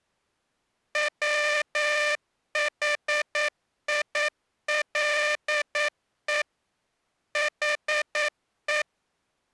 Morse code, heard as a buzzer, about 9 wpm. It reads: WHILE HE